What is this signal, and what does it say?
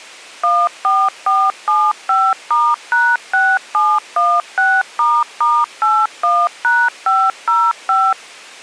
DTMF, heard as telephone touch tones, dialled by machine, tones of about 240 ms. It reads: 14475*#6716**81#505